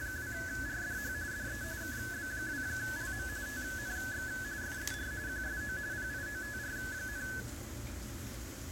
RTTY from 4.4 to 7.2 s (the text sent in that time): FER QSO PIOTR,